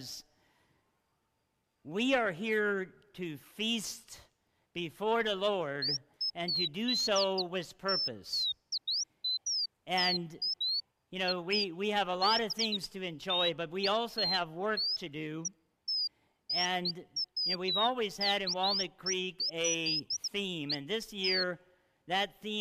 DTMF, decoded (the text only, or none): none